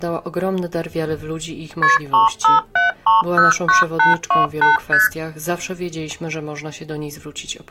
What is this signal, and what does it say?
Multi-frequency trunk signalling (R1, as on North American trunks), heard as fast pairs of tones, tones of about 150 ms. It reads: KP 357309828 ST